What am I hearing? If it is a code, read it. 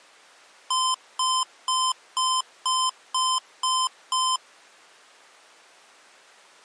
Beep code, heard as beeps from a small speaker, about 1030 Hz. 8 short. In AMI BIOS tables: display memory failure; in Dell tables: LCD failure.